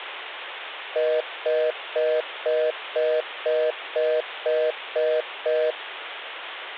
Telephone call progress tone (North American plan), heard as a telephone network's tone, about 480, 620 Hz, 0.25 s on and 0.25 s off. Congestion tone.